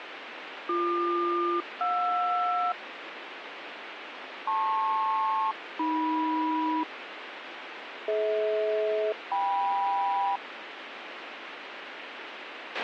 Aircraft SELCAL, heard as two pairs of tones, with radio hiss and a squelch burst at the end. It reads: BQ-JR LP-AM DH-KM